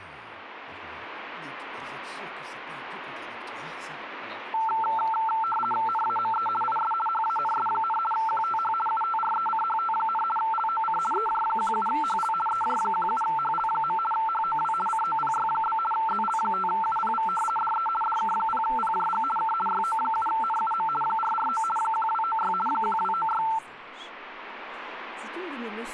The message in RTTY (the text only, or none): NAME IS HANS, QTH UTRECHT, LOC EJ17HL EJ17HL. HOW COPY? ZL5UPV DE DK0PJG K YO7NUM 449 1296 1296